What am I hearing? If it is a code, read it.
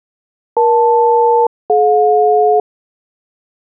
Aircraft SELCAL, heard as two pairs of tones. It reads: EL-DJ